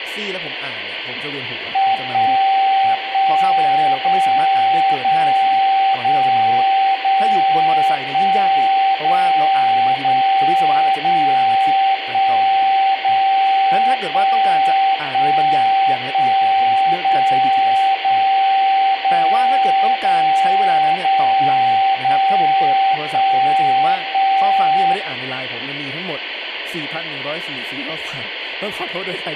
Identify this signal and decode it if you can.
Radio time signal (DCF77), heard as a tone whose level steps once a second, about 780 Hz, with radio static, room echo and speech in Thai. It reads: 1 1 0 0 0 0 1 0 0 0 1 0 1 1 1 0 0 0 0 0 0 1 1